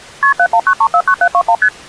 Multi-frequency trunk signalling (R1, as on North American trunks), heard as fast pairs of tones, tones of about 70 ms. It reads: KP 719349721 ST